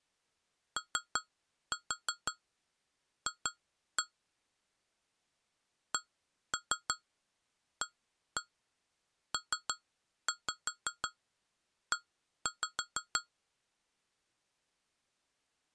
Tap code, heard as taps on glass, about 5 knocks a second. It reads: OF CAPE